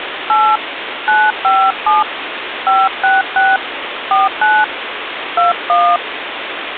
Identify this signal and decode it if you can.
DTMF, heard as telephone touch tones, dialled by hand, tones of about 200 ms, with phone line noise. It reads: 8 957 566 49 21